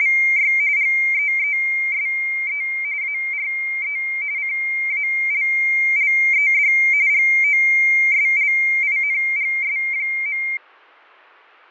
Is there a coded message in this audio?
Yes: RTTY (45.45 baud, 170 Hz shift) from 0.0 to 10.6 s, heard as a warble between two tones, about 2200 Hz centre, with fading. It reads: … GEESE ARE CALLED GOSLINGS.